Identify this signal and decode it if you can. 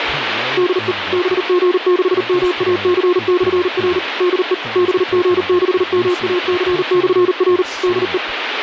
Morse code, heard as a keyed tone, machine-sent, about 39 wpm, 360 Hz, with radio static and speech in English. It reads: DE BG6MAC/R DE BG6MAC/R DE